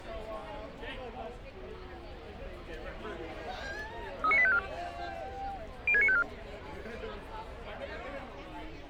Five-tone selective call (ZVEI), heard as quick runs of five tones, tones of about 70 ms, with street noise. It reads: 39854 06954